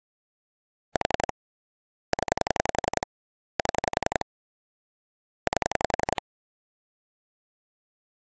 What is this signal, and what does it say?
Pulse dialling, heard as clicks on a phone line, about 11 pulses a second. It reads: 4 0 7 8